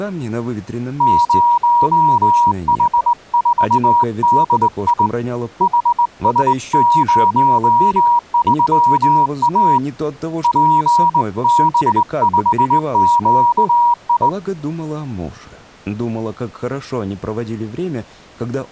Morse code, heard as a keyed tone, hand-sent with a straight key, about 20 wpm, 960 Hz. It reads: 0H4DI HS03A PB5QI